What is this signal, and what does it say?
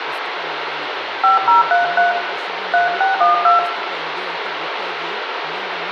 DTMF, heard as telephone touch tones, dialled by hand, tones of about 140 ms, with phone line noise, room echo and speech in Kannada. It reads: 5033 3612